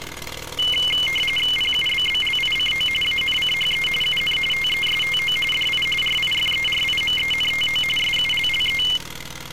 RTTY (45.45 baud, 850 Hz shift), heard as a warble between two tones, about 2550 Hz centre, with street noise. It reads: PUBBLICO ANCHE UN TESTO DI RIFERIMENTO SULLE